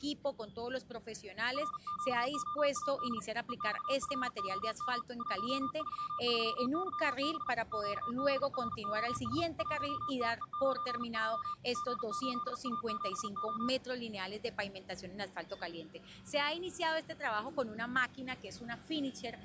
Morse code, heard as a keyed tone, hand-sent with a paddle, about 40 wpm, 1200 Hz. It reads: RQOAD EXFOM 133YB QBROS 1TE9J G8A7O